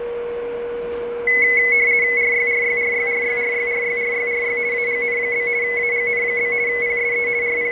RTTY (50 baud, 170 Hz shift), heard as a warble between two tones, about 2100 Hz centre, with radio static, fading, a steady whistle near 480 Hz and the noise of a cafe. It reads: RYRYRYRYRYRYRYRY AGN? AGN? PSE …